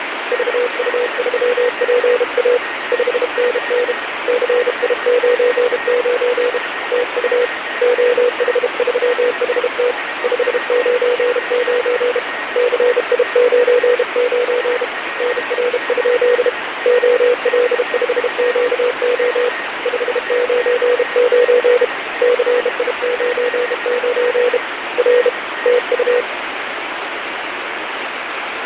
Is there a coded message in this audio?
Yes: Morse code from 0.3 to 26.3 s, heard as a keyed tone, hand-sent with a bug key, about 32 wpm, 490 Hz, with radio static and a weaker station near 1870 Hz. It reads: VU3PA 5NN CI99 TU OH3HT 599 CI99 NR? OL5QO 599 CI99 R TU